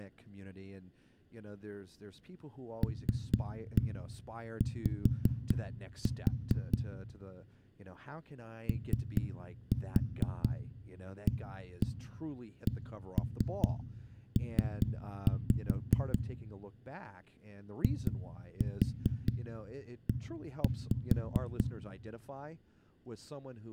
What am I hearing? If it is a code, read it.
Tap code, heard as knocks on a wall, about 4 knocks a second, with room echo and speech in English. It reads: LY OACP IE